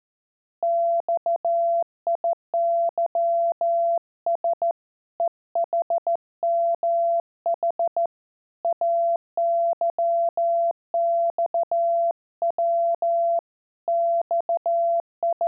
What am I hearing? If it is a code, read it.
Morse code, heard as a keyed tone, hand-sent with a straight key, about 14 wpm, 680 Hz. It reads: XIYS EHMH AYXW …